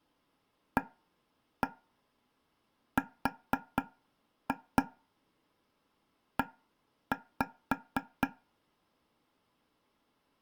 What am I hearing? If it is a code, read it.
Tap code, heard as taps on a table, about 4 knocks a second. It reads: ARE